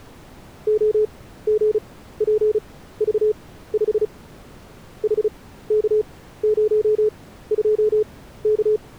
Morse code, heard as a keyed tone, machine-sent, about 35 wpm, spaced as for 16 wpm, 430 Hz. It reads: OGPV5 HK02K